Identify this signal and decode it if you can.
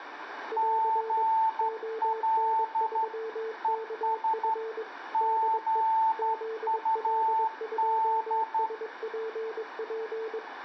Morse code, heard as two keyed tones, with radio static and room echo. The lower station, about 22 wpm, 450 Hz: <AR> ON3KF DE ZL2SPP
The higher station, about 12 wpm, 890 Hz: GL ES GUD